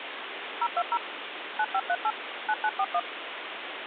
DTMF, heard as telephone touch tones, dialled by machine, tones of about 60 ms, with phone line noise. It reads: 020 9538 9941